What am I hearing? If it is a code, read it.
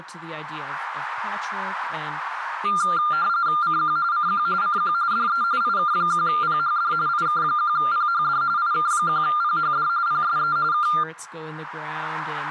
RTTY (45.45 baud, 170 Hz shift), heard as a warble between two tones, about 1290 Hz centre, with radio static and speech in English. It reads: CQ CQ CQ DE IK1PHD IK1PHD IK1PHD PSE K